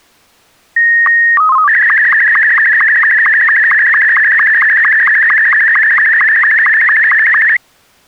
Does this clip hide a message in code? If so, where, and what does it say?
Yes: SSTV (slow-scan television), Martin M2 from 0.8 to 7.6 s, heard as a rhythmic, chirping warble.